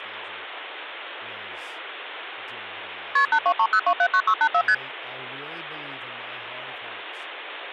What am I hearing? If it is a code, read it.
Multi-frequency trunk signalling (R1, as on North American trunks), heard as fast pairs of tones, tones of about 70 ms, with phone line noise and speech in English. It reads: KP 8230279684 ST